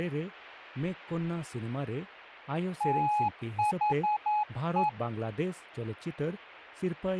Morse code, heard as a keyed tone, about 10 wpm, 840 Hz, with speech in Santali. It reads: THE